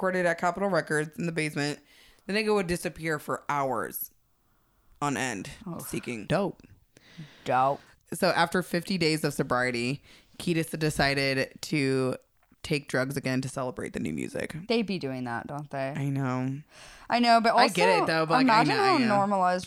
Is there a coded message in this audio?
No, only speech in English.